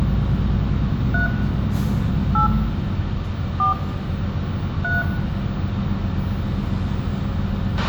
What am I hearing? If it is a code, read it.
DTMF, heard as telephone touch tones, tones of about 150 ms, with radio hiss, a squelch burst at the end, room echo and the noise inside a bus. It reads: 3 8 4 3